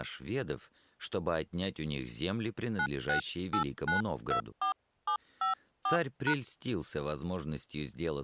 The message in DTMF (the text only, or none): 968924754#